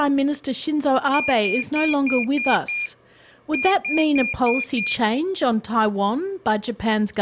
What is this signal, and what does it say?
Beep code, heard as a piezo beeper, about 2400 Hz, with speech in English. 6-5.